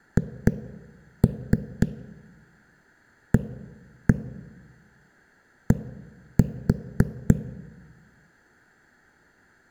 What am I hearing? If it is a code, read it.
Tap code, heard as knocks on a wall, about 3 knocks a second, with room echo. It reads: HAD